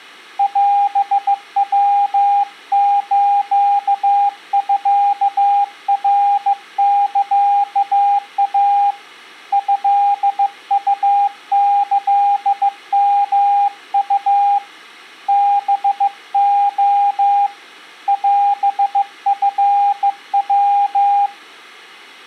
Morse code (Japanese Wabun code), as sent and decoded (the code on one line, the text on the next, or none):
.-... .-- ---.- ..-.- .-. -.-.- .- / ..-.. ..- -.-.. -- ..- / -... --- / .-... ..-. .--
オヤスミナサイ トウキヨウ ハレ オチヤ